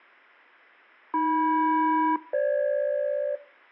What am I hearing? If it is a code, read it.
Aircraft SELCAL, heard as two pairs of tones. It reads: AM-FG